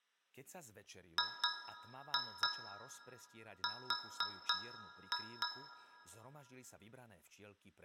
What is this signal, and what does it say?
Tap code, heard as taps on a metal pipe, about 4 knocks a second, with room echo and speech in Slovak. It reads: GR